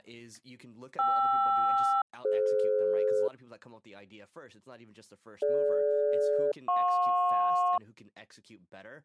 Aircraft SELCAL, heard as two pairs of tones, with speech in English. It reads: KR-DF DG-JP